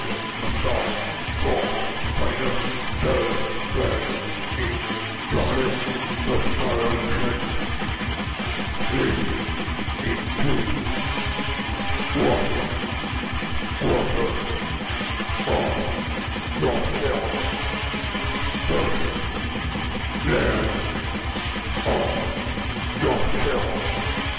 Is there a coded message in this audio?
No.